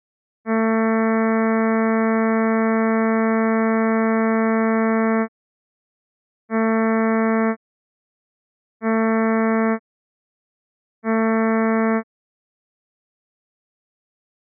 Ship horn signal, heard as a ship's horn, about 220 Hz. 1 long, 3 short. At sea: a vessel under tow in fog.